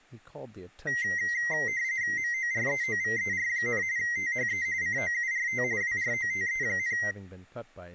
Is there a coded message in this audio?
Yes: RTTY (45.45 baud, 170 Hz shift) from 0.9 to 7.1 s, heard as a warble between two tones, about 2000 Hz centre, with speech in English. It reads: MOREOVER, THE COURT WROTE,